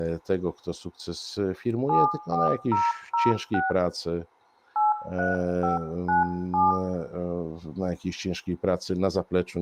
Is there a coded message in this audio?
Yes: DTMF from 1.9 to 6.7 s, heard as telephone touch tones, dialled by hand, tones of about 160 ms, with room echo and speech in Polish. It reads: 74006 83597